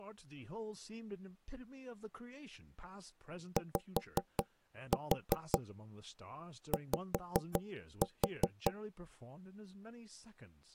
Tap code, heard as knocks on wood, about 5 knocks a second, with speech in English. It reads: YY